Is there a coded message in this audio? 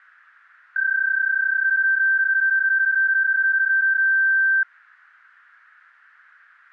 Yes: PSK31 (31.25 baud) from 0.8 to 4.6 s, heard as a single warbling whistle, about 1550 Hz.